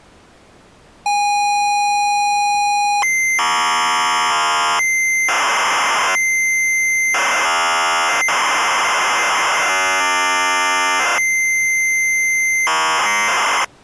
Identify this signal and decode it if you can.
ZX Spectrum tape loading, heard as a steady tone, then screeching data.